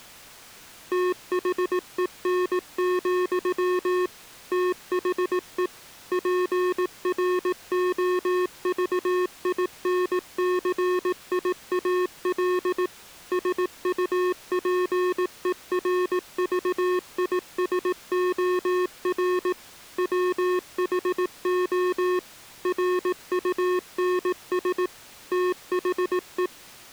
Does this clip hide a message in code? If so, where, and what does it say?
Yes: Morse code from 0.9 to 26.5 s, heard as electronic beeps, machine-sent, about 18 wpm, 360 Hz. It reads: THEN, THE PROVINCIAL SUPERVISOR WHO RUNS THE